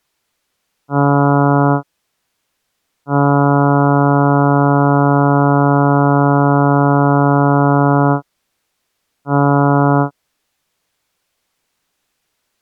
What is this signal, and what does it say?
Ship horn signal, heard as a ship's horn, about 140 Hz. 1 short, 1 long, 1 short. At sea: a vessel at anchor warns of its position.